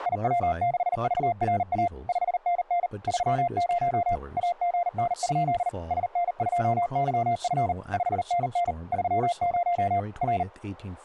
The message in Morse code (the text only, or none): IW6VRA 5NN 30 AGN? SN2YF 5NN 30 R